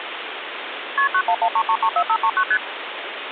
Multi-frequency trunk signalling (R1, as on North American trunks), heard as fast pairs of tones, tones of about 70 ms, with phone line noise. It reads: KP 9113334539 ST